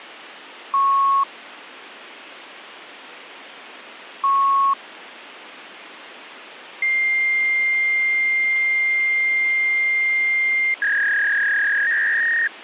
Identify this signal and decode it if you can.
Fax machine handshake, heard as beeps, a long tone and a warble, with phone line noise.